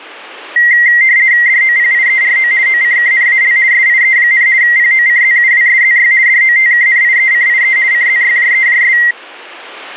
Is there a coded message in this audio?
Yes: RTTY (50 baud, 170 Hz shift) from 0.6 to 9.1 s, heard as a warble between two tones, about 2000 Hz centre. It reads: DOPIERO OCKNAL SIE, POCZUWSZY DOTKNIECIE CZYJEJS